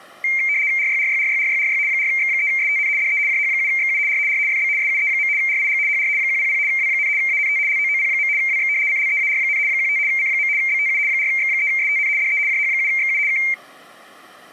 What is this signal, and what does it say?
RTTY (75 baud, 170 Hz shift), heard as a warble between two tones, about 2200 Hz centre. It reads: RYRYRYRYRY 4X3STN DE JH7XU R R FB SUE. RIG HR 100 W, ANT LOOP. WX CLEAR, 15 C. BTU 4X3STN DE JH7XU K